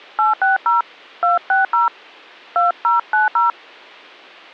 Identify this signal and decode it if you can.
DTMF, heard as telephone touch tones, dialled by hand, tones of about 150 ms. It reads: 860 260 2090